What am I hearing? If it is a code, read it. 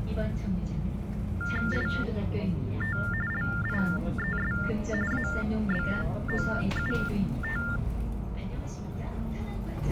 TTY/TDD text telephone tones (45.45 baud Baudot), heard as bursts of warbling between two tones, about 400 Hz shift, 1600 Hz centre, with the noise inside a bus. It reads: IT LIES ABOUT